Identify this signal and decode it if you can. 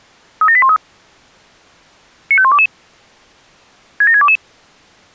Five-tone selective call (ZVEI), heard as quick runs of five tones, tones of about 70 ms. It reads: 37813 95122 67622